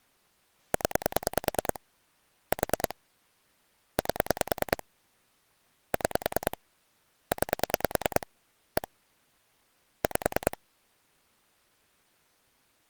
Pulse dialling, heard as clicks on a phone line, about 10 pulses a second. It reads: 0 4 8 6 9 1 5